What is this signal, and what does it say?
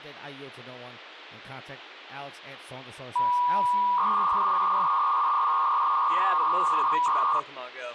300-baud modem data (V.21 tones), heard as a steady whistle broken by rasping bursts, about 300 baud, 200 Hz shift, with phone line noise and speech in English.